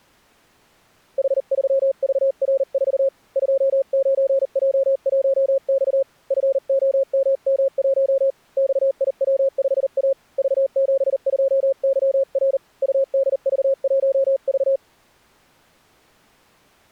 Morse code, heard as a keyed tone, hand-sent with a paddle, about 39 wpm, 540 Hz. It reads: H3VR4 29J1X FOMM1 XIW5A V72YR UDV1V